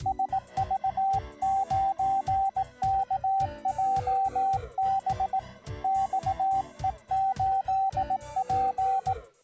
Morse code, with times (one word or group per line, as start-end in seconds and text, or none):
0.1-5.4 SV9KJB
5.8-9.1 XE8P